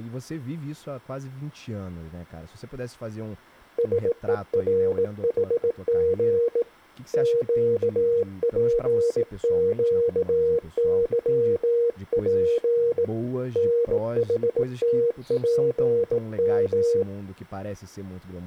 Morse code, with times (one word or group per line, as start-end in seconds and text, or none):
3.8-6.6 SERHG
7.1-13.0 QPQYP
13.6-17.0 NHTPM